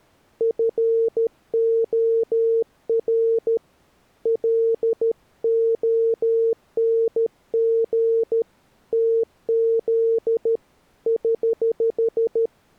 Morse code, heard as a keyed tone, hand-sent with a paddle, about 13 wpm, 460 Hz. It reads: FOR LONG TZ <HH>